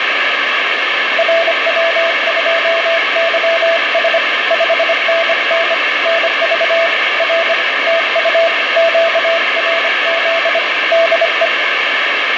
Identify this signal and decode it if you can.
Morse code, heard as a keyed tone, hand-sent with a bug key, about 25 wpm, 660 Hz, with heavy radio static and fading. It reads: RW2YS 5NN NV R TU QRZ DE